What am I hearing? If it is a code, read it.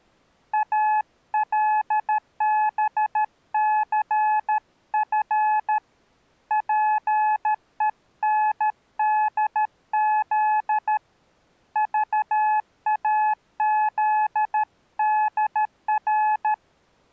Morse code, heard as a keyed tone, hand-sent with a paddle, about 13 wpm, 860 Hz. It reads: ALBCF PENDZ VAZDR